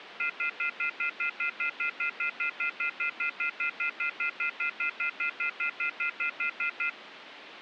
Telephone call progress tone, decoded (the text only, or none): off-hook warning tone